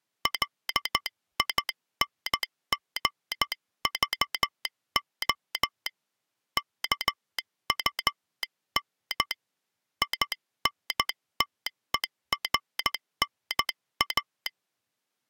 Morse code, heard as a telegraph sounder, hand-sent with a straight key, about 13 wpm. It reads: LINGVO KUN INTERNA